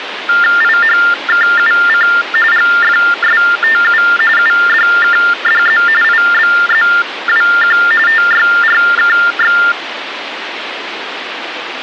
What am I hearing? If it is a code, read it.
TTY/TDD text telephone tones (45.45 baud Baudot), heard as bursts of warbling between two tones, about 400 Hz shift, 1600 Hz centre, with phone line noise. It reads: IHKUC GFSTU UDKDZ IBZWQ TYRKX